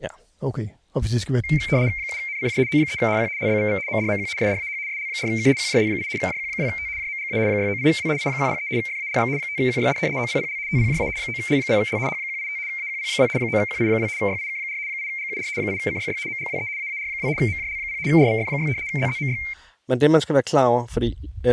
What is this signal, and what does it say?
RTTY (75 baud, 170 Hz shift), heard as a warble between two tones, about 2200 Hz centre, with speech in Danish. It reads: 7NCJ O3HQ LBVV MDMQ SDAH SL4K QJL8 JQ2T JMGA 698W I103 FALX 5QYD OPPL TPJA 9L0L H185 AQP2 9QI2 YIK4 8GUR 8CYY MGWE AAR2 MJL0 RVF6 ZZMY